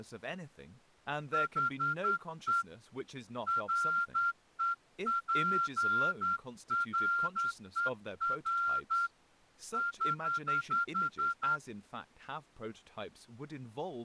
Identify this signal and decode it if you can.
Morse code, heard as a whistle, hand-sent with a straight key, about 10 wpm, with speech in English. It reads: HE REPRER <HH>